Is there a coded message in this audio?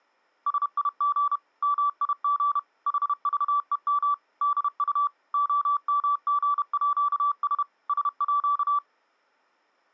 Yes: Morse code (with Danish letters) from 0.4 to 8.8 s, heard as a keyed tone, machine-sent, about 31 wpm, 1160 Hz. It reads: SIG MIG HVEM DU OMGÅS SÅ